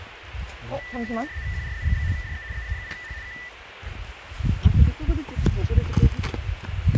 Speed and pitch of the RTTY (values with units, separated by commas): 75 baud, 170 Hz shift, 1900 Hz centre